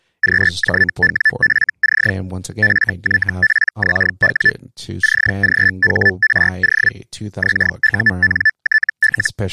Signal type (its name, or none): Hellschreiber